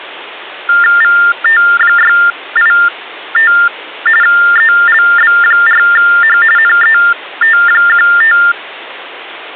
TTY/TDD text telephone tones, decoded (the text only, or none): VT685 ELB4H NET15